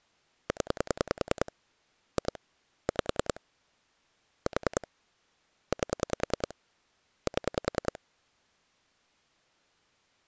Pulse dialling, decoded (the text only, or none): 0 2 5 4 8 7